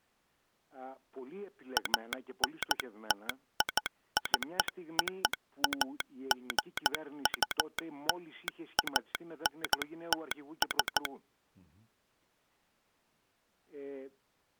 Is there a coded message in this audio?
Yes: Morse code (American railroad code) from 1.7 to 11.1 s, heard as a telegraph sounder, machine-sent. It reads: ANTICOAGULANTS